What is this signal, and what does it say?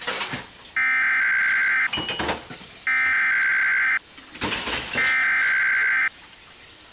Emergency Alert System (SAME) tones (header bursts), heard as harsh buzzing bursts, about 520.83 baud, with kitchen noise.